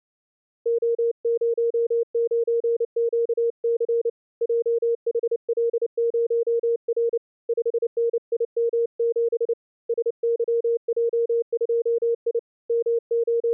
Morse code, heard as a keyed tone, hand-sent with a paddle, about 29 wpm, 470 Hz. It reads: O09QC JHL0R 5NIM7 SYJ2I …